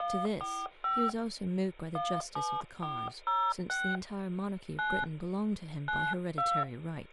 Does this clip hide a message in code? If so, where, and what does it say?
Yes: DTMF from 0.0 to 6.6 s, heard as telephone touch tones, dialled by hand, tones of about 250 ms, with hum and speech in English. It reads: 145 17406 9 92